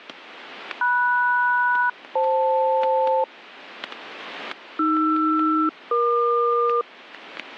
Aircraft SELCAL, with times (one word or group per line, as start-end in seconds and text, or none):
0.8-3.2 MS-FL
4.8-6.8 AR-EQ